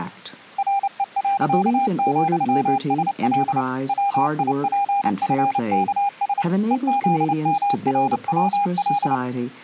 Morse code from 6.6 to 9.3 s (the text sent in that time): EZMRWL